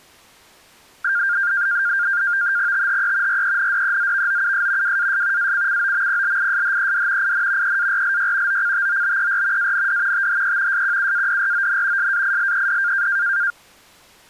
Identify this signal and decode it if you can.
NAVTEX (SITOR-B), 100 baud, 170 Hz shift, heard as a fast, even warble, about 1500 Hz centre. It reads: THE RENDEZVOUS WAS ACCOMPLISHED IN EARLY OCTOBER AND THE SQUADRON SAILED